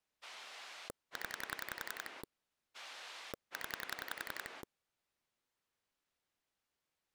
Pulse dialling, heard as a rotary dial, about 11 pulses a second. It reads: 0 0